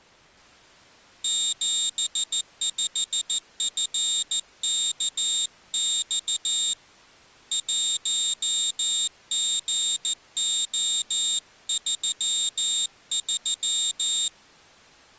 Morse code, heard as a high beeper, hand-sent with a paddle, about 14 wpm, 3700 Hz. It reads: 75FKX 1GO33